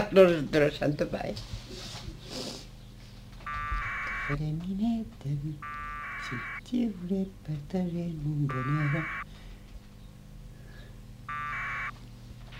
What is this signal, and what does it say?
Packet radio (AX.25, as in APRS), 1200 baud, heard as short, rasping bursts, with a squelch burst at the end.